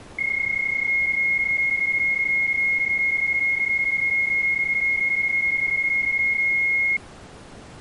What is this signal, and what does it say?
PSK31 (31.25 baud), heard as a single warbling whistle, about 2150 Hz.